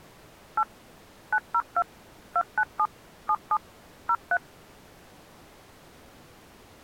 DTMF, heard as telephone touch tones, dialled by machine, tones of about 60 ms. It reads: 8 902 297 77 03